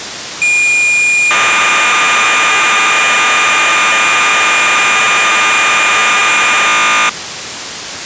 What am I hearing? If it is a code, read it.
Cassette data (Kansas City type), 1200 baud, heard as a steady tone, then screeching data, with tape hiss.